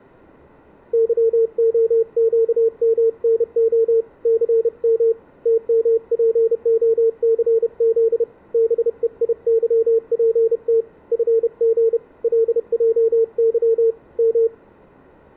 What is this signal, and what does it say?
Morse code, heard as a keyed tone, hand-sent with a paddle, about 31 wpm, 450 Hz. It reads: YOQMNO CM TMPOCZ BEIYPT FG LJY M